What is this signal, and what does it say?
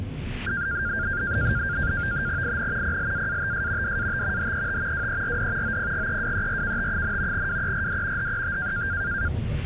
NAVTEX (SITOR-B), 100 baud, 170 Hz shift, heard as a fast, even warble, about 1500 Hz centre, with the noise inside a bus. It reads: IN PLAATS DAT HET WERD OPGEWERKT, WERD HET